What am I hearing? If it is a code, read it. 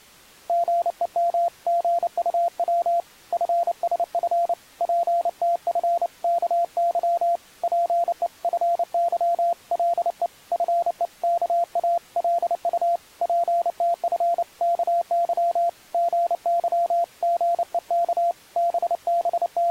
Morse code (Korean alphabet), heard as a keyed tone, hand-sent with a paddle, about 29 wpm, 690 Hz. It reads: 삼십 년 전에 자네가 나오기 전에 세상 …